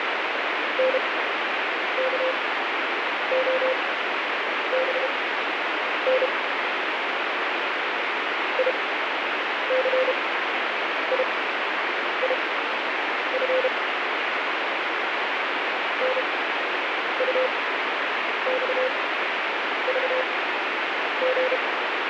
Morse code, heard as a keyed tone, machine-sent, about 32 wpm, spaced as for 8 wpm, 520 Hz, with heavy radio static. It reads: NKOBN ICIIF NUXVG